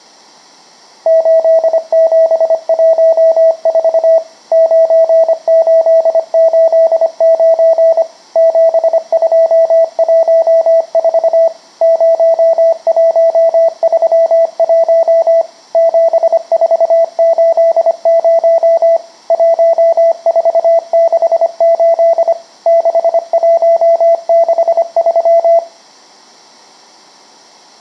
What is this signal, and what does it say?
Morse code, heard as a keyed tone, machine-sent, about 25 wpm, 660 Hz, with room echo. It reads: 8714 9889 7214 0131 7480 1468 6163